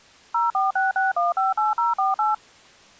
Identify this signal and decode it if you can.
DTMF, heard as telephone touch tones, dialled by machine, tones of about 160 ms. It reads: 0466158048